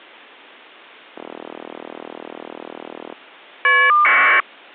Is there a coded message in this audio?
Yes: caller ID data burst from 1.1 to 4.4 s, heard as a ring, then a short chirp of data, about 1200 baud.